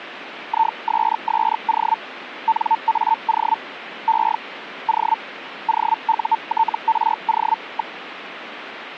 Hellschreiber (Feld-Hell, 122.5 baud), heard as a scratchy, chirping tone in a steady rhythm, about 900 Hz, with radio static. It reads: ISSO NAO E O OUTRO.